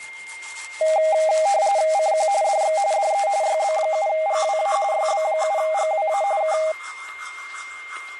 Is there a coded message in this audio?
Yes: RTTY (45.45 baud, 170 Hz shift) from 0.8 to 6.7 s, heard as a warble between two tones, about 720 Hz centre, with static crashes, a steady whistle near 2110 Hz and the noise of a restroom. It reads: CQ DX DE YB7GWA YB7GWA K